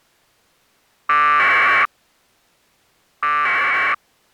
Packet radio (AX.25, as in APRS), 1200 baud, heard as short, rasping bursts.